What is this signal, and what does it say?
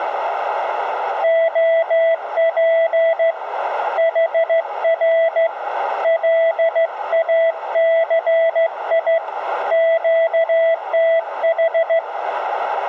Morse code, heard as a keyed tone, hand-sent with a straight key, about 14 wpm, 660 Hz, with radio static and a narrow filter. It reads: OP HR LACI QTH